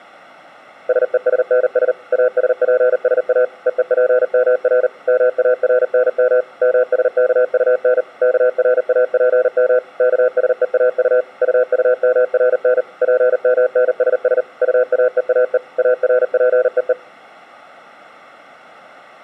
Morse code, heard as a keyed tone, machine-sent, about 39 wpm, 500 Hz. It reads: SESNS ASPSA EEPMR MARNM MSKUN KRAPM KSEAU UUMRN PMNSS UAEAE ARPEE